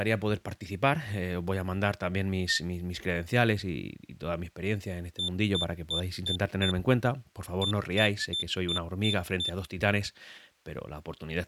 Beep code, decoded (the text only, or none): 5-6